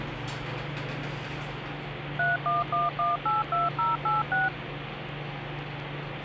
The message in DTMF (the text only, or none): 311182086